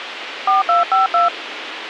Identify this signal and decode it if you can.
DTMF, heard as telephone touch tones, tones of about 150 ms, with radio hiss. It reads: 4252